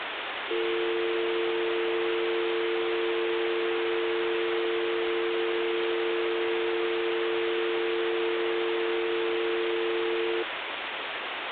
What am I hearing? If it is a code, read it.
Telephone call progress tone (North American or UK plan), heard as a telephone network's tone, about 350, 450 Hz, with phone line noise. Dial tone.